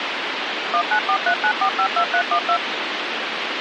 DTMF, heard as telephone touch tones, dialled by machine, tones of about 80 ms, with phone line noise. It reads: 19439452312